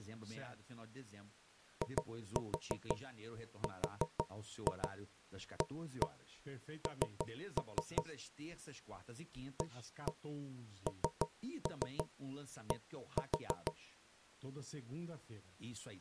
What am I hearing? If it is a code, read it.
Tap code, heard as knocks on wood, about 6 knocks a second, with speech in Portuguese. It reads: IRAN AND